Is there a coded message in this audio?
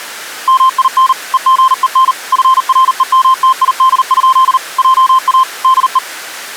Yes: Morse code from 0.4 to 6.0 s, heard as a keyed tone, machine-sent, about 39 wpm, 1050 Hz. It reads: MIN EGEN FREMTID? JA DE